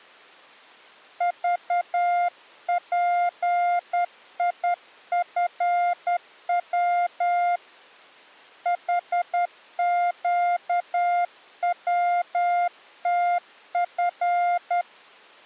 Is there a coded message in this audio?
Yes: Morse code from 1.1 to 14.9 s, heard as a keyed tone, hand-sent with a straight key, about 10 wpm, 700 Hz. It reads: VPIFW HQWTF